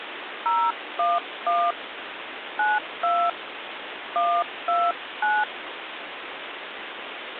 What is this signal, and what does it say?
DTMF, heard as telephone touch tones, dialled by hand, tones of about 230 ms, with phone line noise. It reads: 011 92 129